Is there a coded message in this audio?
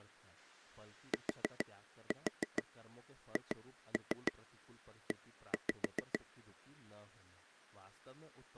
Yes: tap code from 1.1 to 6.2 s, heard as taps on a table, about 6 knocks a second, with speech in Hindi. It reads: THE